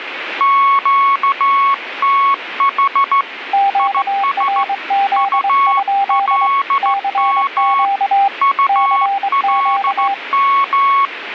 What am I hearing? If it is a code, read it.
Morse code, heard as two keyed tones, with radio static. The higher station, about 15 wpm, 1110 Hz: QTH IS ULM ULM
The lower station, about 23 wpm, 790 Hz: QRZ? CQ CQ